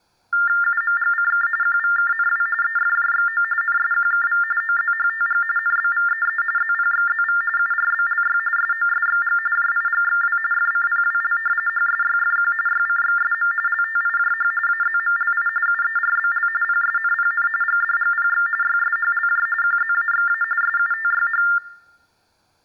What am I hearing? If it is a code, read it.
TTY/TDD text telephone tones (45.45 baud Baudot), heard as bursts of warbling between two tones, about 400 Hz shift, 1600 Hz centre. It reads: UMGCK QVKNW EFJXO NSQKV OZHTG NBVEE ZPXZV URBLY SOSXG JIGXW FCPWL HSYFQ YCXSM LTIJH AZMLI UERBL PSNPN GDGPX YSHLJ QZAXA SUTYH